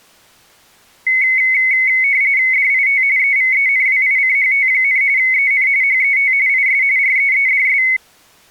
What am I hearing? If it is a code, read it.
RTTY (45.45 baud, 170 Hz shift), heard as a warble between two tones, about 2150 Hz centre. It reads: DIT EVENWICHT, EN HET IS REEDS